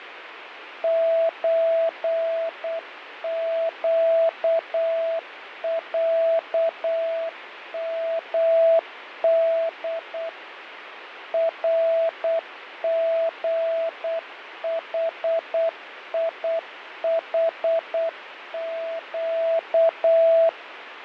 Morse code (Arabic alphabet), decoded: زقعمد رغحيحق

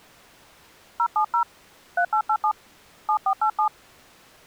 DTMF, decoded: 070 3887 7487

